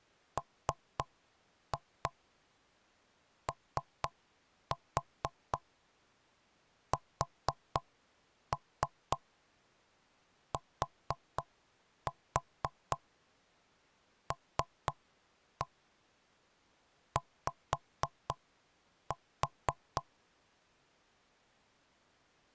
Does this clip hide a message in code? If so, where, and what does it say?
Yes: tap code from 0.4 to 20.1 s, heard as knocks on wood, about 4 knocks a second. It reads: MOSTLY